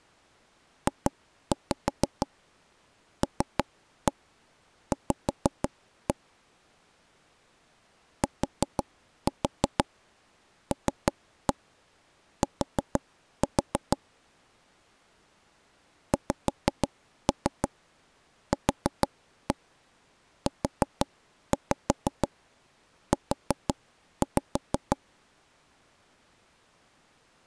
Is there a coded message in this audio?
Yes: tap code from 0.9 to 25.0 s, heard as taps on a table, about 6 knocks a second. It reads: JLV TLT XQUU